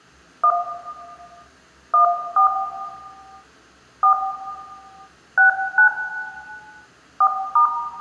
DTMF, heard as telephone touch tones, dialled by hand, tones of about 100 ms, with room echo. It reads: 1 14 4 69 4*